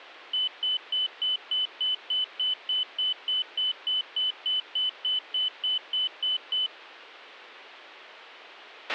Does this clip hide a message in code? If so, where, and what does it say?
No, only evenly repeated beeps, with a squelch burst at the end.